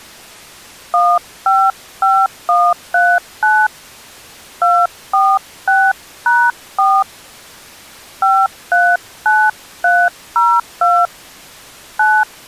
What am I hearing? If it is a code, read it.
DTMF, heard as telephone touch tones, dialled by hand, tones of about 240 ms. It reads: 155139 246#4 539302 9